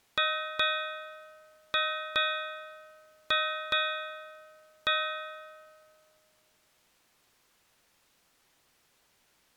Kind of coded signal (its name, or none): ship's bell